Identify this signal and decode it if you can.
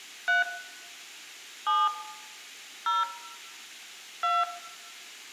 DTMF, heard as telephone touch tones, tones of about 190 ms, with room echo. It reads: 3 7 0 2